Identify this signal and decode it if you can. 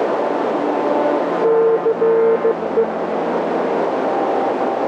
Morse code, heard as a keyed tone, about 15 wpm, 450 Hz, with radio static and a narrow filter. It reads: CE